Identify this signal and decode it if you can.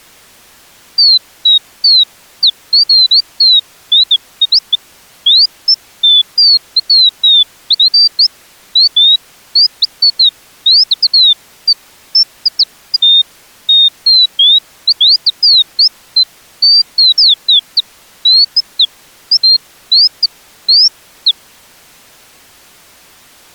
Bird-like chirps. There is no code.